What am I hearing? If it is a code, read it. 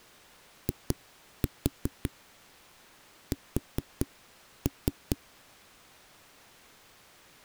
Tap code, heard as knocks on a wall, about 4 knocks a second. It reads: IS